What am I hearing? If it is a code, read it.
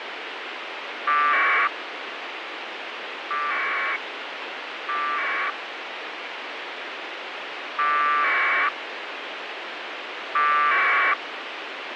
Packet radio (AX.25, as in APRS), 1200 baud, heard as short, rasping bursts, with radio hiss.